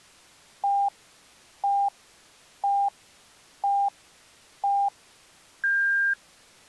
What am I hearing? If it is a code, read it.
Radio time signal (five pips and a higher one, as on Chinese radio), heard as pips.